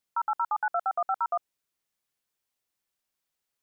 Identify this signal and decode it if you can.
DTMF, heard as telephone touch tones, dialled by machine, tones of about 60 ms. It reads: 08079251501